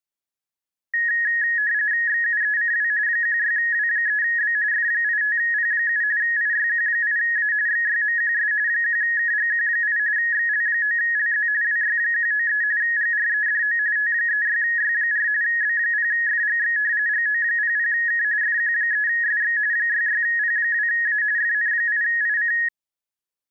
RTTY (45.45 baud, 170 Hz shift), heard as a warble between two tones, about 1800 Hz centre. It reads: XUECW 16W3B F85P7 IYQ8A XYMQS 1KGQ8 XL9LZ WY193 GREDO T36Y4 B0FGX GO00K FQ3SX 66P2A FN8IC